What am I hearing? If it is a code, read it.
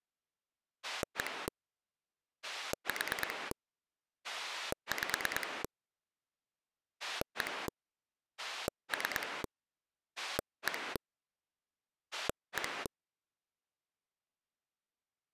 Pulse dialling, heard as a rotary dial, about 9 pulses a second. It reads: 1 4 5 1 3 1 1